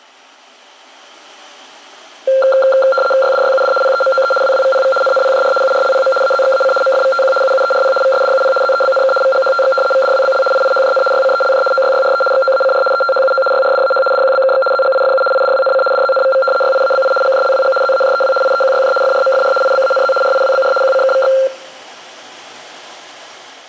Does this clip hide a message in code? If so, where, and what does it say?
Yes: RTTY (75 baud, 850 Hz shift) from 2.3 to 21.5 s, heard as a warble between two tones, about 960 Hz centre, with room echo. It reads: YDYUD PEMOE WWVPV NNPJR URLPM AZXAC MFVTQ UUERP VSDUP ZEBNK VGHTX VDWBL IIHJN YCELJ OYYRE XOACR ETHUO YRDAH DQBKX ZGIFU IDWNC DZNVV YIABI GJLWG ZAJEW IEQYJ FRMFR IBANZ RIWBR QCKVX